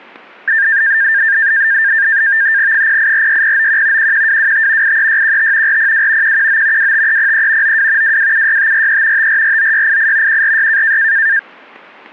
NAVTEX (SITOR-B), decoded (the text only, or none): 0846091 11225 83615 402 119 25303 92 2276543 5449688 146